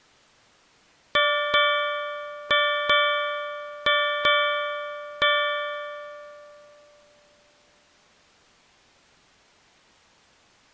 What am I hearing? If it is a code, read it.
Ship's bell, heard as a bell. 7. Seven half-hours of the watch have passed.